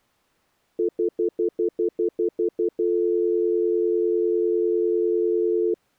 Telephone call progress tone (North American plan), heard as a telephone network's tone, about 350, 440 Hz, 0.1 s on and 0.1 s off. Stutter dial tone.